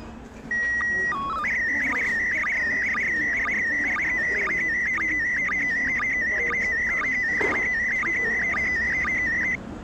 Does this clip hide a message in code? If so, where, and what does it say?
Yes: SSTV (slow-scan television), PD 120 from 0.5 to 9.6 s, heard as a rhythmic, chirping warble, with the noise of a crowd indoors.